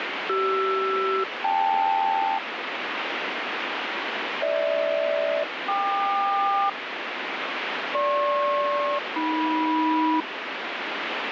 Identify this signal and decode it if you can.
Aircraft SELCAL, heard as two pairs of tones, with radio static. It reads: CR-KL GH-KQ GP-AM